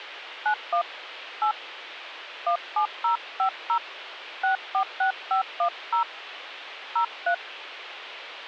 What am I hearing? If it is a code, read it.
DTMF, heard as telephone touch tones, dialled by hand, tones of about 100 ms, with radio hiss. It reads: 91 8 17050 646510 03